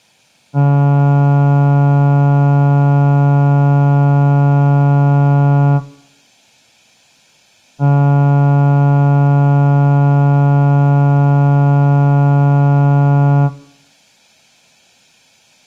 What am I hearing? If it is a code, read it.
Ship horn signal, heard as a ship's horn, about 140 Hz. 2 long. At sea: a vessel under power that has stopped in fog.